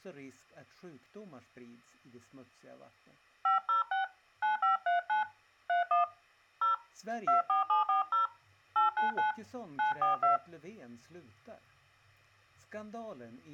DTMF, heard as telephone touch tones, dialled by hand, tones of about 130 ms. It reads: 506 9539 31 0 24740 899 942